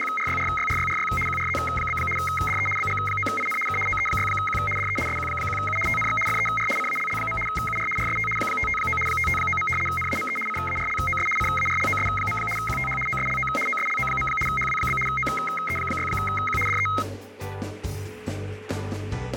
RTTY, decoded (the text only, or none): … QRZ? DE BG9IN K OE6Q DE SQ1U TNX FER CALL. UR RST 559 559. NAME CARLOS CARLOS. QTH OSLO OSLO. HW? OE6Q DE